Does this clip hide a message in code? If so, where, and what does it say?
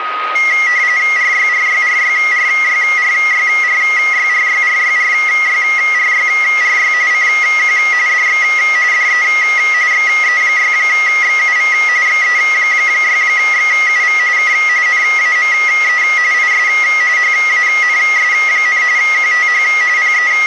Yes: RTTY (45.45 baud, 170 Hz shift) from 0.4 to 20.5 s, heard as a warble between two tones, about 2050 Hz centre, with radio static and a steady whistle near 1250 Hz. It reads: RYRYRYRYRYRYRYRYRYRYRY CQ DX DE XE6XUV XE6XUV K NAME IS HANS, QTH …